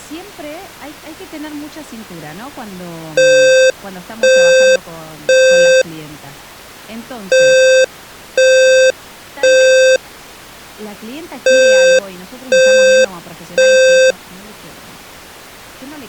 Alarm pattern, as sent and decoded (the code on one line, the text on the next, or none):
3 beeps and a pause
temporal three